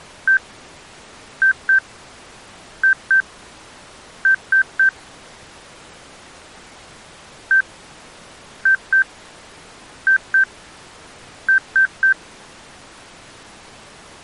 Beep code, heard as beeps, played twice, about 1550 Hz. 1-2-2-3. In Phoenix BIOS tables: BIOS ROM checksum failure.